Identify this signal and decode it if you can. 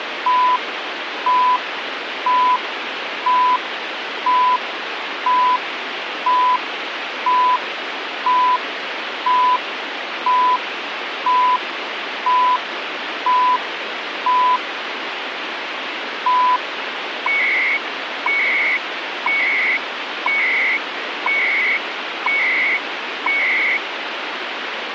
Radio time signal (CHU, Canada), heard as beeps and data bursts, one a second, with radio static.